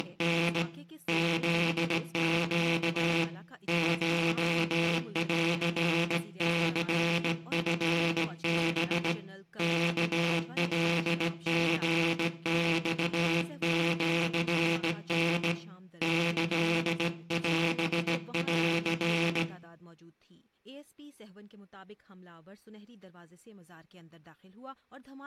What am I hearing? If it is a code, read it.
Morse code (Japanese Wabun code), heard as a buzzer, hand-sent with a straight key, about 17 wpm, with room echo. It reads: … フネ コンニチハ ワカリマシタ キオン